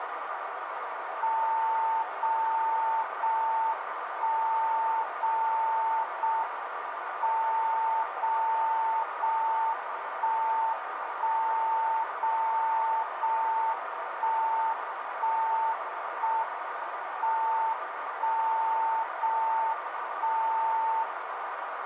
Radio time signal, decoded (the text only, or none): 0 0 1 0 0 M 0 0 1 1 0 0 1 1 1 M 1 0 1 0